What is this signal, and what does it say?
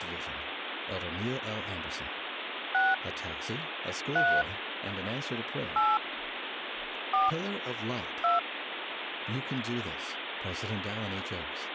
DTMF, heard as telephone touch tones, dialled by hand, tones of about 200 ms, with phone line noise and speech in English. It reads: 6 3 8 4 2